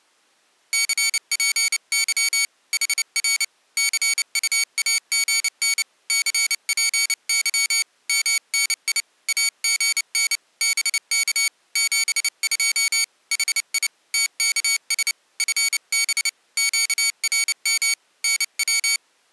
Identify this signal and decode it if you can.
Morse code, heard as a high beeper, hand-sent with a paddle, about 29 wpm, 2250 Hz. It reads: CPY HR CUAGN CPY MNI AGN BK 72 HI TKS FB QRM NW